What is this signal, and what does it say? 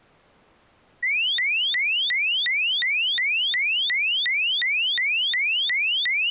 A tone that sweeps in pitch again and again. There is no code.